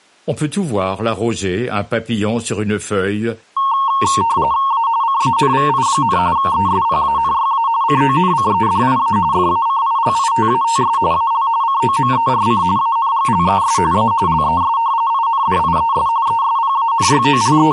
RTTY (45.45 baud, 170 Hz shift), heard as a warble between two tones, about 1000 Hz centre. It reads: A CANVI, ESPANYA CONCEDIA FACILITATS AL COMERC ANGLES A LES INDIES …